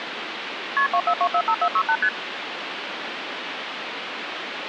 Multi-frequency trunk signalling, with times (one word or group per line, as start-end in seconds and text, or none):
0.8-0.9 KP
0.9-2.0 24245468
2.0-2.1 ST